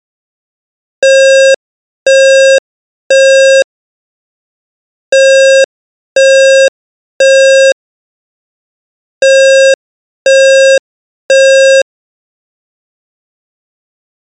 Alarm pattern, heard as an alarm's beeps, played three times, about 540 Hz. Temporal three. Smoke or fire, evacuate.